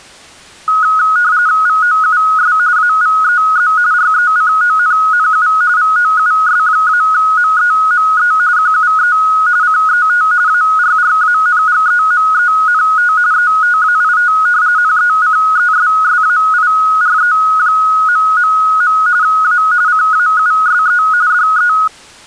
RTTY (45.45 baud, 170 Hz shift), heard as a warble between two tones, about 1360 Hz centre. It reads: VOUS AVEZ RECONNU VOUS-MEME QUE CET ARRANGEMENT ETAIT NECESSAIRE... A CAUSE DE